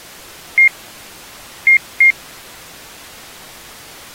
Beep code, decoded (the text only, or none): 1-2